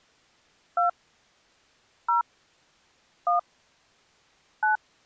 DTMF, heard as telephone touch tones, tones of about 130 ms. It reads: 2 0 1 9